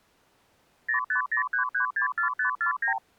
Multi-frequency trunk signalling (R2, with the far end's replies), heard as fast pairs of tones, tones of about 110 ms. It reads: 0503364549